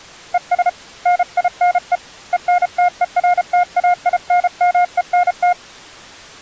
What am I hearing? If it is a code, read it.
Morse code, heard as a keyed tone, hand-sent with a paddle, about 33 wpm, 710 Hz. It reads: ES NINE ENTERTAINMENT